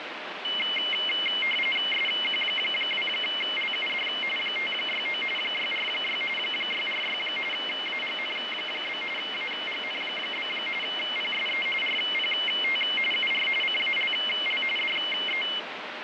RTTY (45.45 baud, 850 Hz shift), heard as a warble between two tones, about 2550 Hz centre, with radio static. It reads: SQ2LUD 569 646 646 AGN? AGN? PSE RPT UR CALL DE